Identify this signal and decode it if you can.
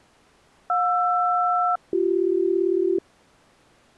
Aircraft SELCAL, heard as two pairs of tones. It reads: JR-BC